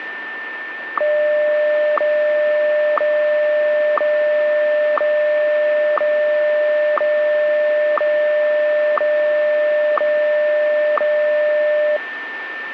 Radio time signal (WWVH, Hawaii), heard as ticks, one a second, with radio static and a steady whistle near 1790 Hz.